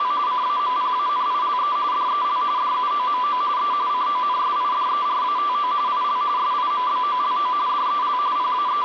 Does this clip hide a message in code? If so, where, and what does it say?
Yes: RTTY (45.45 baud, 170 Hz shift) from 0.0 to 8.8 s, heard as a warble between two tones, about 1090 Hz centre, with radio static. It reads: … CAMPANILE DEL DUOMO E CONSIDERATO IL SIMBOLO DEL …